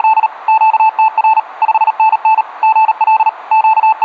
Morse code, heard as a keyed tone, machine-sent, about 38 wpm, 880 Hz. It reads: … QTR 5NN GL …